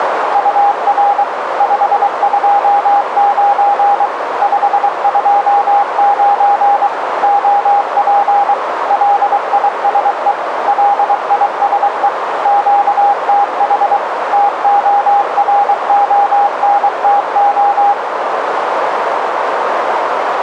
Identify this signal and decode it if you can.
Morse code, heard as a keyed tone, machine-sent, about 23 wpm, 810 Hz, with radio static and a narrow filter. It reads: UR 529 529 OP LISE LISE QTH TORONTO